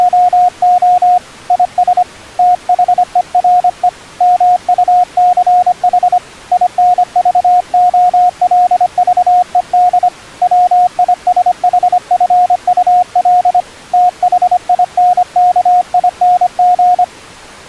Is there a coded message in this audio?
Yes: Morse code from 0.0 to 17.1 s, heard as a keyed tone, hand-sent with a paddle, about 25 wpm, 720 Hz. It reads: … IS THERE MUCH INVOLVED WISHFUL THINKING